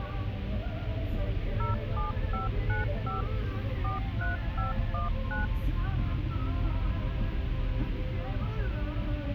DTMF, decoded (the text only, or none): 07595 43519